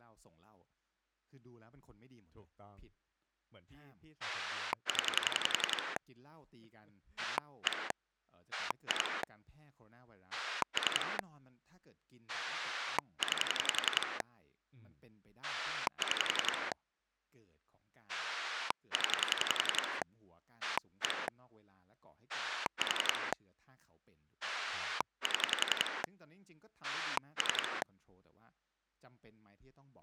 Pulse dialling, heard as a rotary dial, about 11 pulses a second, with speech in Thai. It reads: 0 1 2 3 9 6 0 1 4 7 3